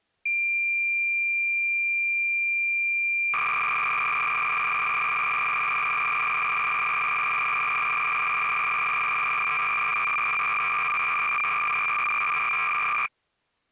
Cassette data (Kansas City type), 300 baud, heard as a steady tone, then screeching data.